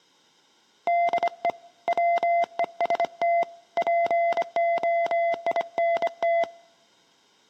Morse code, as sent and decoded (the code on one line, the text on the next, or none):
-.. . / .-- . ... - / .--. --- .. -. -
DE WEST POINT